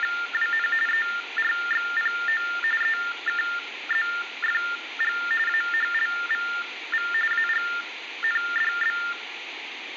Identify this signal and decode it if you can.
TTY/TDD text telephone tones (45.45 baud Baudot), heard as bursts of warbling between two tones, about 400 Hz shift, 1600 Hz centre, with phone line noise. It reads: … ERXPO EKZFG AHLVV AGNDB